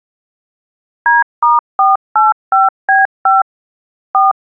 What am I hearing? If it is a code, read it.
DTMF, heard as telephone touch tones, dialled by machine, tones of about 170 ms. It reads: D*485B5 4